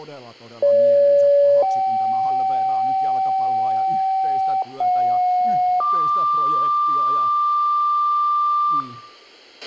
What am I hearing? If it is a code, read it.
Two-tone page, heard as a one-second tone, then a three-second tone, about 570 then 770 Hz, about 730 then 1180 Hz, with a squelch burst at the end, room echo and speech in Finnish.